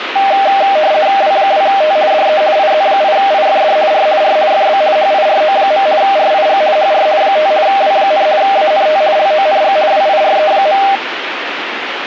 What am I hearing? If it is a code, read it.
RTTY (50 baud, 170 Hz shift), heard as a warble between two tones, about 700 Hz centre, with radio static. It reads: W2T DE IZ8IFD R R FB HIRO. RIG HR 5 W, ANT LONG WIRE.